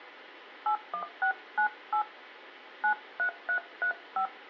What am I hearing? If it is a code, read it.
DTMF, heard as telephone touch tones, dialled by hand, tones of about 90 ms. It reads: 81698 93335